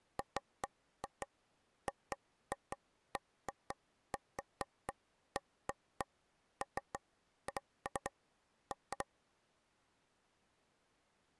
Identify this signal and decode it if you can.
Irregular taps on a table. There is no code.